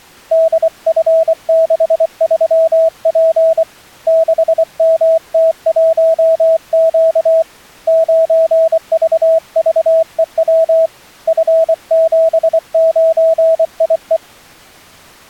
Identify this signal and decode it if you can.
Morse code, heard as a keyed tone, hand-sent with a paddle, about 24 wpm, 650 Hz. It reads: DF63P 6MT1Q 9VVEW F79IE